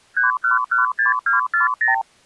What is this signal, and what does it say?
Multi-frequency trunk signalling (R2, with the far end's replies), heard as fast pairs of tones, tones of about 140 ms. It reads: 3116240